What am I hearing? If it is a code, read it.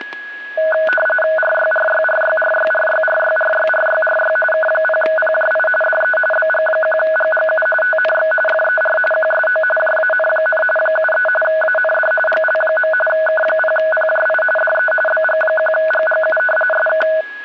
RTTY (45.45 baud, 850 Hz shift), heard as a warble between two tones, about 1060 Hz centre, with static crashes and a steady whistle near 1670 Hz. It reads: RYRYRYRYRYRYRYRYRY K0PJI DE BG1GGU TNX FER QSO JAN, 73 AND GL. K0PJI DE BG1GGU SK